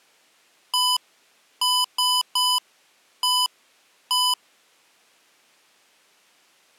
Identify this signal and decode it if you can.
Beep code, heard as beeps from a small speaker, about 1000 Hz. 1-3-1-1. In Phoenix BIOS tables: memory refresh test failure.